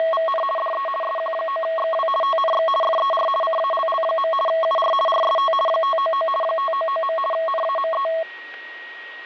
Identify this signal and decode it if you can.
RTTY (50 baud, 450 Hz shift), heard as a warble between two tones, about 880 Hz centre, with fading and a steady whistle near 1890 Hz. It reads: … DE SQ9XW TNX FER CALL. UR RST 599 599. NAME